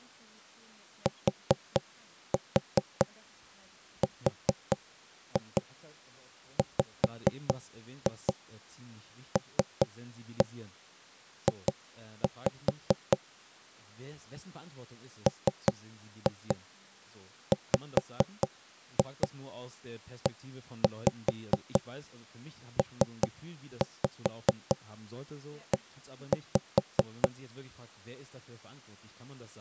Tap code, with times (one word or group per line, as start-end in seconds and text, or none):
1.1-13.2 TRWLJ
15.3-27.3 MWEPE